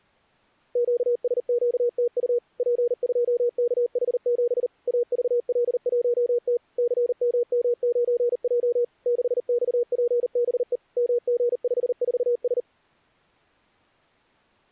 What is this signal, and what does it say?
Morse code, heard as a keyed tone, machine-sent, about 39 wpm, 480 Hz. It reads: QSQTU P2KH7 AVL1T CMM9J 6XPBE MG54S